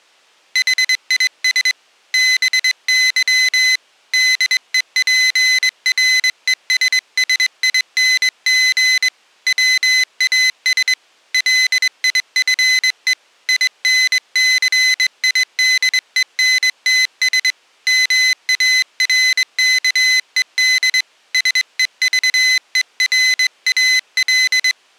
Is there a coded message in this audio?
Yes: Morse code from 0.5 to 24.8 s, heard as a high beeper, hand-sent with a straight key, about 22 wpm, 2050 Hz. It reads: HIS BY DEPRESSING WAS LIFE INCIDENTS MARKED SEVERAL